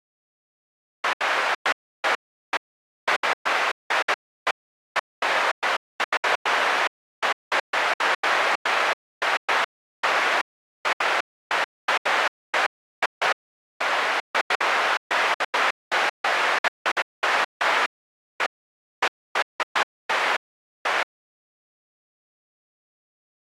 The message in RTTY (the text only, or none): none